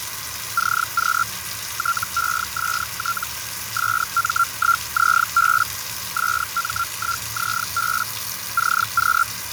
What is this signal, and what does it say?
Hellschreiber (Feld-Hell, 122.5 baud), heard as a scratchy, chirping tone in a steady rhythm, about 1370 Hz, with radio static, fading, a narrow filter and the noise of a restroom. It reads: CQ TEST SM1ZB SM1ZB CQ